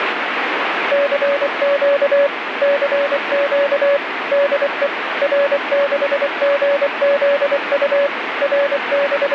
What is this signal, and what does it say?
Morse code, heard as a keyed tone, machine-sent, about 24 wpm, 570 Hz, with radio static. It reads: CQ CQ DE R6GZU …